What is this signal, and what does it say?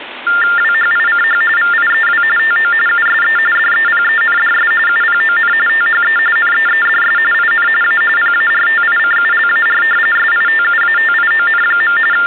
TTY/TDD text telephone tones (45.45 baud Baudot), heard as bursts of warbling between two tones, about 400 Hz shift, 1600 Hz centre, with phone line noise. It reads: WHICH VIEW TO USE DEPENDS UPON THE NEEDS IN A PARTICULAR SITUATION. …